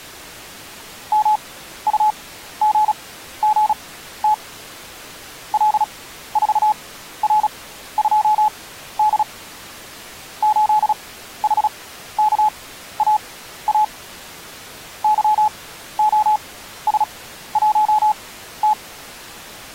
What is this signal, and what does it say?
Morse code, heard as a keyed tone, machine-sent, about 36 wpm, spaced as for 14 wpm, 850 Hz. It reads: MUGGT L4R2D 8HKAA YOS1T